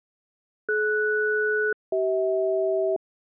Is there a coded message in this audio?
Yes: aircraft SELCAL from 0.7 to 3.0 s, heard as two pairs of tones. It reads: DS-CH